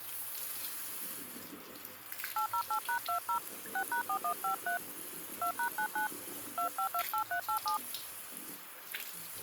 DTMF, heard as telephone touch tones, dialled by hand, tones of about 100 ms, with the noise of a restroom. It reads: 808#20 6#4153 2#99 2528387